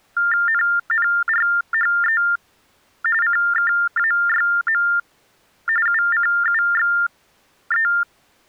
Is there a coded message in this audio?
Yes: TTY/TDD text telephone tones (45.45 baud Baudot) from 0.2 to 8.0 s, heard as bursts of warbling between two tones, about 400 Hz shift, 1600 Hz centre. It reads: NNRHE CKAYM UCUXE